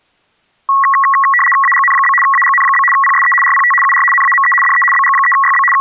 RTTY (75 baud, 850 Hz shift), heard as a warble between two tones, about 1500 Hz centre. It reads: AGN? AGN? PSE RPT UR NAME DE BG3YB …